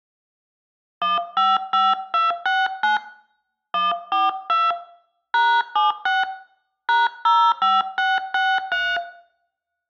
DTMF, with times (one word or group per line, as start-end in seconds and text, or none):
1.0-3.0 155269
3.7-4.7 142
5.3-6.2 #76
6.9-9.0 #05663